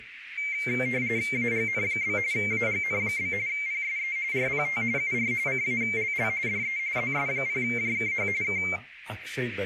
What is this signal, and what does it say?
RTTY (45.45 baud, 170 Hz shift), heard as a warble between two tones, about 2200 Hz centre, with radio static, a narrow filter and speech in English. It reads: AGN? AGN? PSE RPT UR CALL DE ZS0JKH K